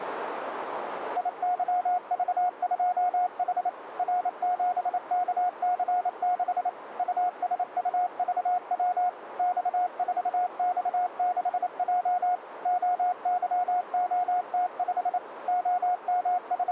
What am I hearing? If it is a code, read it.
Morse code, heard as a keyed tone, machine-sent, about 28 wpm, 720 Hz, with radio static and a narrow filter. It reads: IYV2H R7KC6 USUVW X4X6J OYOT5 …